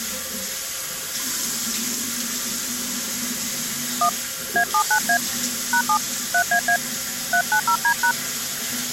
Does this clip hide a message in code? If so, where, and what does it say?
Yes: DTMF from 4.0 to 8.1 s, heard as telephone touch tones, dialled by hand, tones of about 80 ms, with the noise of a restroom. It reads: 1 A79A #7 3AA 390D#